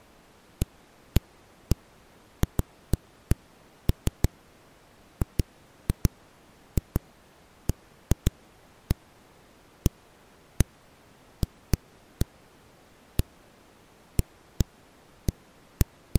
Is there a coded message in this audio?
No, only irregular knocks on a wall.